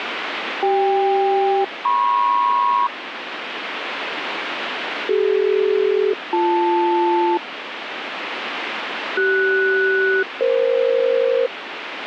Aircraft SELCAL, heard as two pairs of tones, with radio static. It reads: CK-MP CD-BL CS-EF